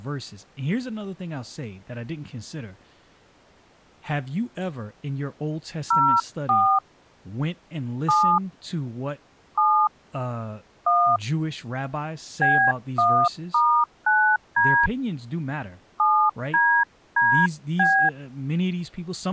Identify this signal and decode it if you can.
DTMF, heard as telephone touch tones, dialled by hand, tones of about 300 ms, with speech in English. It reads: 04 7 7 1 B1*9D 7DDB